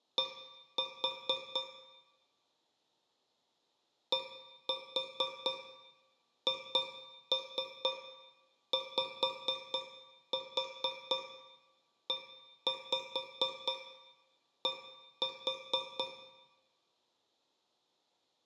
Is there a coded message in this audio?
Yes: tap code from 0.2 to 16.3 s, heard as taps on a metal pipe, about 4 knocks a second, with room echo. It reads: D DHYED